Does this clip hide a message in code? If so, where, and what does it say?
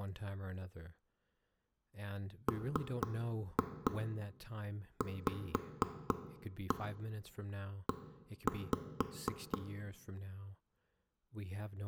Yes: tap code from 2.5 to 9.6 s, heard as knocks on wood, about 4 knocks a second, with room echo and speech in English. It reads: MVE